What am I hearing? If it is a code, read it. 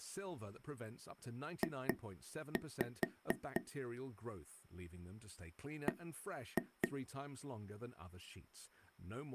Tap code, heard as taps on a table, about 4 knocks a second, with speech in English. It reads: J B